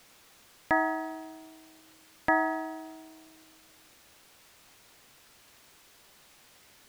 Clock strike, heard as a bell. 2. Two o'clock.